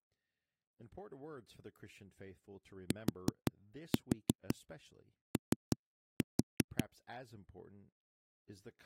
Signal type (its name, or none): tap code